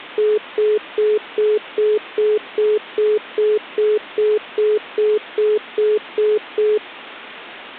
Telephone call progress tone (single-tone plan, as in most of Europe), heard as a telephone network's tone, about 420 Hz, 0.2 s on and 0.2 s off. Congestion tone.